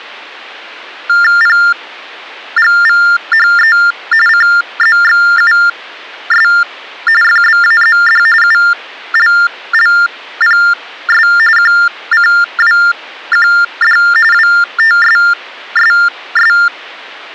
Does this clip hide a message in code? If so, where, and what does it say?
Yes: TTY/TDD text telephone tones (45.45 baud Baudot) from 1.1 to 16.7 s, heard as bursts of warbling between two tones, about 400 Hz shift, 1600 Hz centre. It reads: PGVHE CZXUS FBAZD ULLPS QCWQD WTSSS